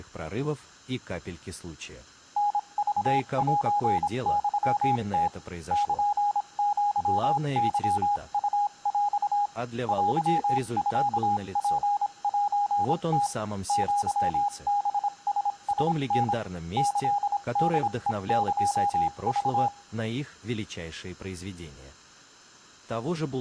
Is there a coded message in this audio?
Yes: Morse code (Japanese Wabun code) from 2.3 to 19.7 s, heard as a keyed tone, machine-sent, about 26 wpm, spaced as for 23 wpm, 820 Hz, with room echo. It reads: タクセユム ルアケウヰ テミツセム アハララタ キホヘエク